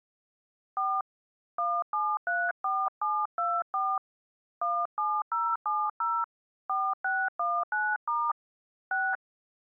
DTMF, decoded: 4 1734724 17070 4619* 6

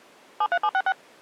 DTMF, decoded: 73766

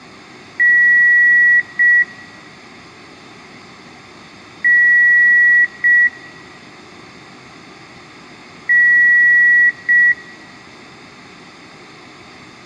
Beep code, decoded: 1 long, 1 short

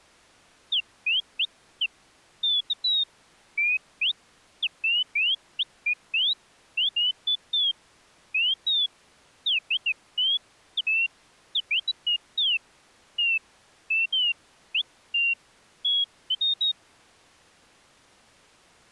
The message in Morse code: none

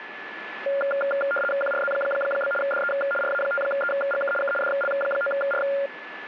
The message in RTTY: QRZ? DE RA5EGK K DL9R

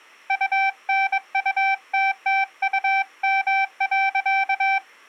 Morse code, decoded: UNUTTUM.

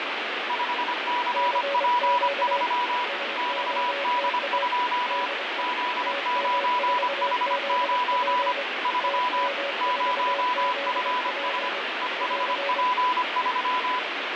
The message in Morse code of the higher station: 5CP3 XD2 Z9H9 3 0FS EHP3

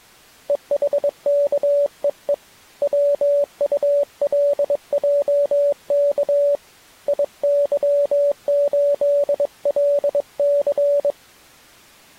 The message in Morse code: EHKEE WULJK IY8LC

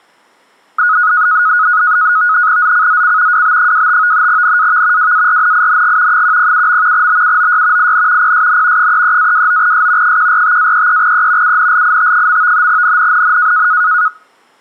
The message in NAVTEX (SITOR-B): ZCZC WB25 NAV WARNING 107. BUOY IN PSN 33-29S 145-33E UNLIT. NNNN

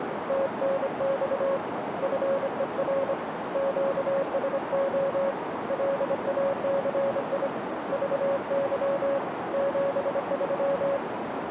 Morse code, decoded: TNX FER QSO LACI VY 73

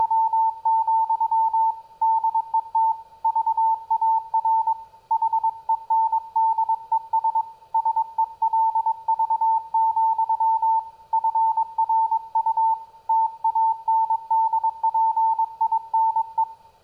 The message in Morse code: … DET VAR HENDES SELV, FRU TANDPINE

